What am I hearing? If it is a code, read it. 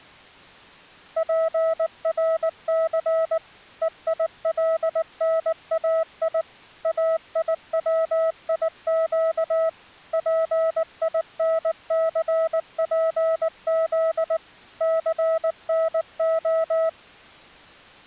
Morse code (Hebrew alphabet), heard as a keyed tone, machine-sent, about 19 wpm, 650 Hz. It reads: פרס וילנאי איציק פינספז סנה